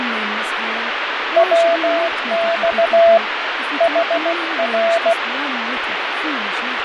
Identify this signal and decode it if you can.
Morse code, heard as a keyed tone, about 16 wpm, 670 Hz, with radio static, fading and speech in English. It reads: WX HR